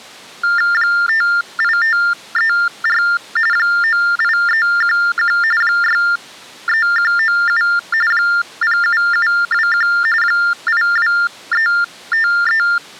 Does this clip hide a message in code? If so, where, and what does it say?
Yes: TTY/TDD text telephone tones (45.45 baud Baudot) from 0.4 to 12.8 s, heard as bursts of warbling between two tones, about 400 Hz shift, 1600 Hz centre. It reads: 58534 98311 63197 07721 82353